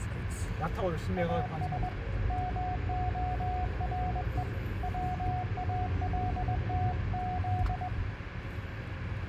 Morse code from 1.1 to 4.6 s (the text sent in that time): AS MORE